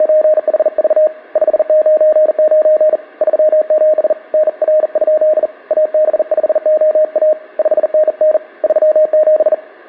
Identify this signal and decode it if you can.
Morse code, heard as a keyed tone, hand-sent with a bug key, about 40 wpm, 620 Hz, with room echo. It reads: … 599 37 NR? AB5OA 5NN 37